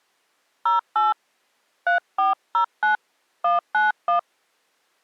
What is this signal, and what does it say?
DTMF, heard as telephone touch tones, dialled by hand, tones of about 130 ms. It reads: 08 3409 191